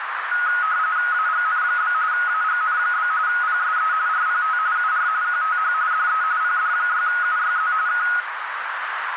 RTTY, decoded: AGN? AGN? PSE RPT UR QTH DE PD6UYZ K

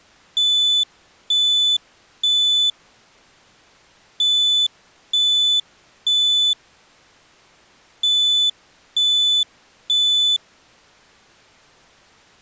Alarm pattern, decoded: temporal three

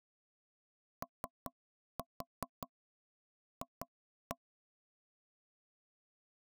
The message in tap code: OF

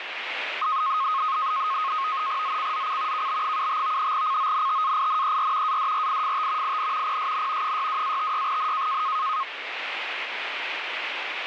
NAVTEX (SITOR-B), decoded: ZCZC KB75 CONTAINER ADRIFT IN PSN 62-56N

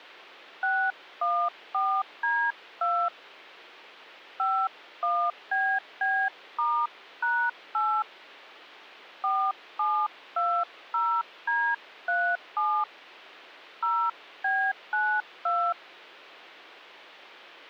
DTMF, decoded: 614D2 51BB*#8 4720D37 0B92

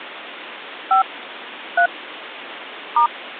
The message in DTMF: 5 3 *

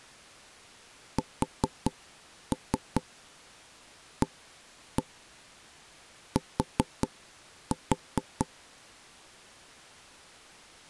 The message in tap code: SAT

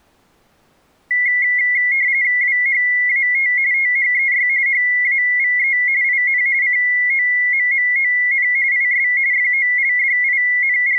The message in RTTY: WHAT THEY HAVE IN COMMON IS …

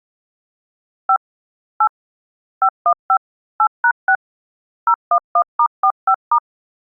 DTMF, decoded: 5 8 515 8#6 011*45*

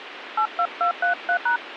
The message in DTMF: 82233#

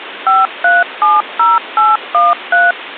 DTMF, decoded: 5370813

